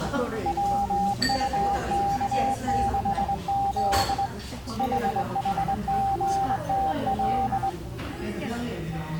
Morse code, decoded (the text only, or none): WUK6Z HHGTL